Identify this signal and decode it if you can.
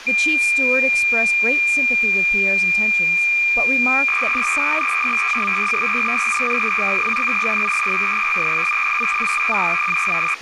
Cassette data (Kansas City type), 300 baud, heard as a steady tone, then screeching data, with tape hiss and speech in English.